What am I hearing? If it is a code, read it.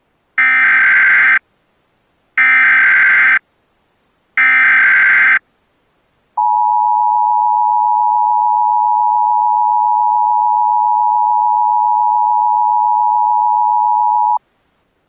Emergency Alert System (SAME) tones (header bursts, then the 853 and 960 Hz attention tone), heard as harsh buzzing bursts, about 520.83 baud.